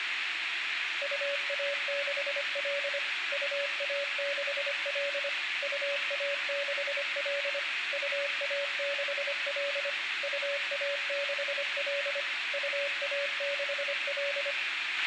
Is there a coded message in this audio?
Yes: Morse code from 1.0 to 14.6 s, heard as a keyed tone, machine-sent, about 25 wpm, 570 Hz, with radio hiss, a squelch burst at the end and room echo. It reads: UA6L UA6L UA6L UA6L UA6L UA6L